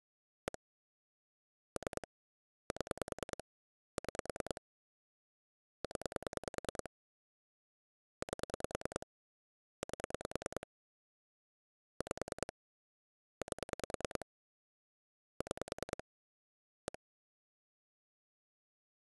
Pulse dialling, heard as clicks on a phone line, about 10 pulses a second. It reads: 1 3 7 6 0 8 8 5 8 6 1